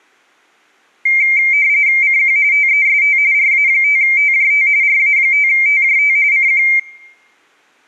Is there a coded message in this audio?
Yes: RTTY (45.45 baud, 170 Hz shift) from 1.1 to 6.8 s, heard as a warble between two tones, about 2200 Hz centre. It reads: CQ TEST RA5TJT RA5TJT CQ